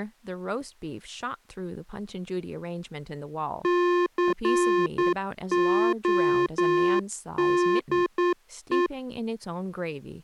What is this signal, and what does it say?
Morse code, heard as electronic beeps, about 9 wpm, 350 Hz, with speech in English. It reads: CODE